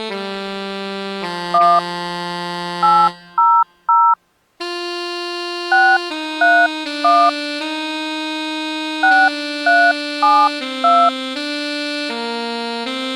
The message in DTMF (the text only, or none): 1 800 631 6372